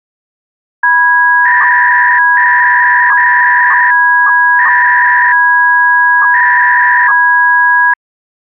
300-baud modem data (V.21 tones), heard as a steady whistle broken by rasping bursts, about 300 baud, 200 Hz shift.